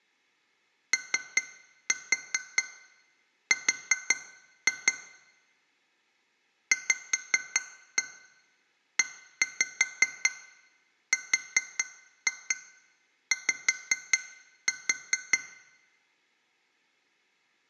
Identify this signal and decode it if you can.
Tap code, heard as taps on glass, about 5 knocks a second, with room echo. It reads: OR VERY